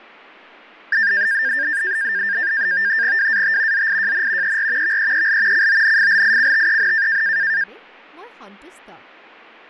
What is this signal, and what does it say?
NAVTEX (SITOR-B), 100 baud, 170 Hz shift, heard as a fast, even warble, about 1700 Hz centre, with fading and speech in Assamese. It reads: WAT ZIJN ER VEEL CONFLICTEN